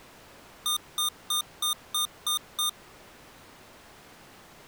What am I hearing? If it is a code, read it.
Beep code, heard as beeps from a small speaker, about 1210 Hz. 7 short. In AMI BIOS tables: virtual mode exception error; in Dell tables: processor failure.